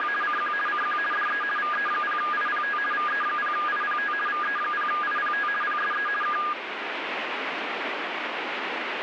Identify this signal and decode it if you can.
RTTY (50 baud, 450 Hz shift), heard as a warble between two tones, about 1430 Hz centre, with radio static. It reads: … CQ CQ DE VE0IPT VE0IPT VE0IPT PSE K